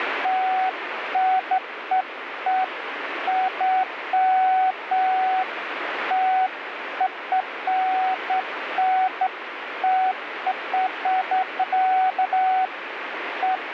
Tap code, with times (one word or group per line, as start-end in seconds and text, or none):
none